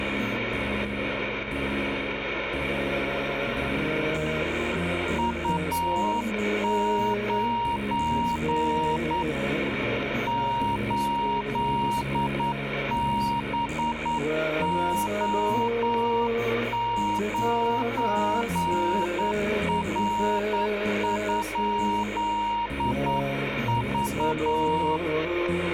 Morse code, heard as a keyed tone, hand-sent with a straight key, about 9 wpm, 940 Hz, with radio static. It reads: U9 8BO9R?V